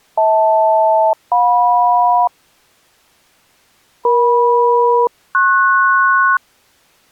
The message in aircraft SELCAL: HL-JM EM-PS

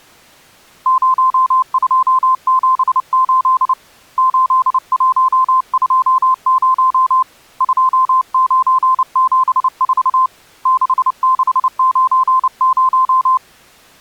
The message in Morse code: 0278 8120 2974 6690

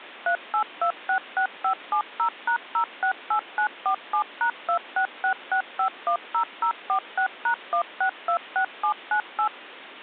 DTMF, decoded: 38266570#068947#2666510046#1626798

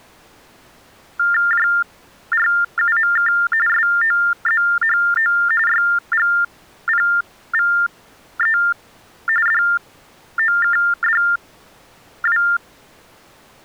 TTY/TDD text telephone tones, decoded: JRUMK SOZHO YGPVE DOKDW

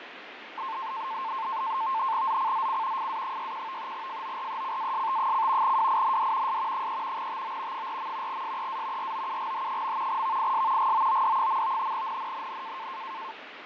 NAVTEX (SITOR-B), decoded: ZCZC FA61 FORECAST: WIND S 3 TO 4. SEA ROUGH. VIS GOOD. NNNN

